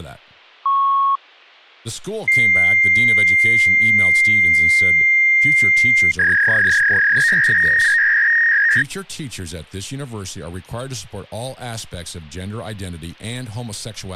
Fax machine handshake, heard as a beep, a long tone and a warble, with speech in English.